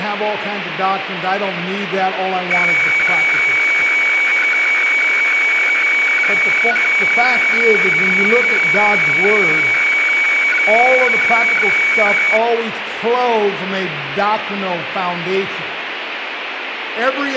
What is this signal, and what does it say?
Weather fax (radiofax), 120 lines a minute, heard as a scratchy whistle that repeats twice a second, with radio static.